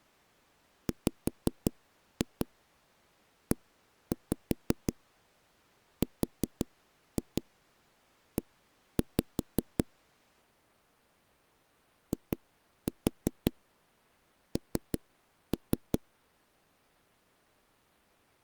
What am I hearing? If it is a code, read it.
Tap code, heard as knocks on a wall, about 5 knocks a second. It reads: WERE IN